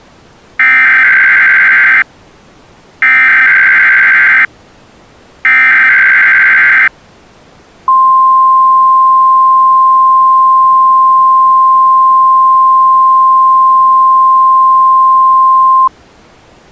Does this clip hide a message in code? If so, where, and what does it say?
Yes: Emergency Alert System (SAME) tones (header bursts, then the 1050 Hz attention tone) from 0.6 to 15.9 s, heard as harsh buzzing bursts, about 520.83 baud.